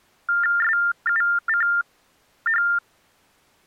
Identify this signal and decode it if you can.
TTY/TDD text telephone tones (45.45 baud Baudot), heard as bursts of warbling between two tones, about 400 Hz shift, 1600 Hz centre. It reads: SUCH